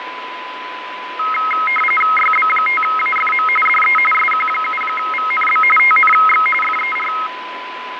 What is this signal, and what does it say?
RTTY (45.45 baud, 850 Hz shift), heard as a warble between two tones, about 1700 Hz centre, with radio static, fading and a steady whistle near 1000 Hz. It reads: YB5AFM DE SQ7VNB TNX FER